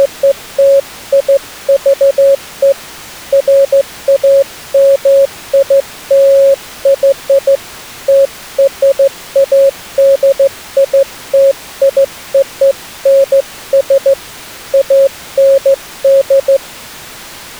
Morse code (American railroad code), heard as a keyed tone, hand-sent with a straight key, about 550 Hz. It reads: … FAMILY TRADITIONS AND